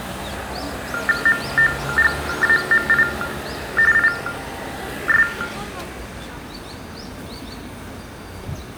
TTY/TDD text telephone tones (45.45 baud Baudot), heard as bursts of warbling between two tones, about 400 Hz shift, 1600 Hz centre, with room echo and the noise of a residential street. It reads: MOGAMI IS